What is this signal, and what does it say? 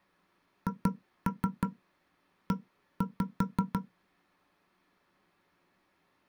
Tap code, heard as knocks on wood, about 5 knocks a second. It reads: HE